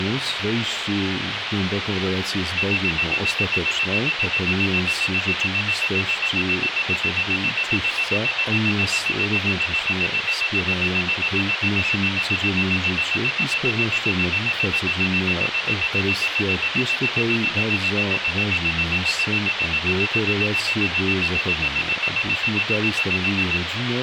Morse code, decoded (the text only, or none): none